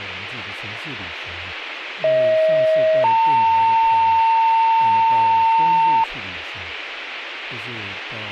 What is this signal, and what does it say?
Two-tone page, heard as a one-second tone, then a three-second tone, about 630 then 900 Hz, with radio hiss and speech in Chinese.